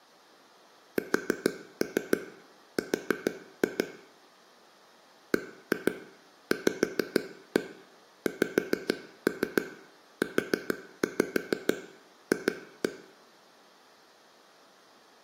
Tap code, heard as taps on a table, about 6 knocks a second, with room echo. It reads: SR BVXUF